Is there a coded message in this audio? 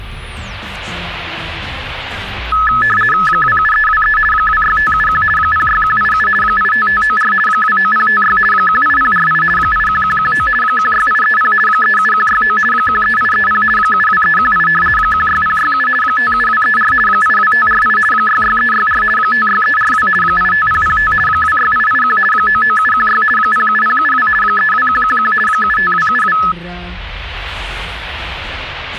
Yes: RTTY (50 baud, 450 Hz shift) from 2.5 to 26.5 s, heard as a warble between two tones, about 1500 Hz centre. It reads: 27323 26571 06187 85594 29056 18048 81119 16830 37169 13830 72318 16067 57234 82548 66364 56342 85005 26881 99716 07072 32111 75272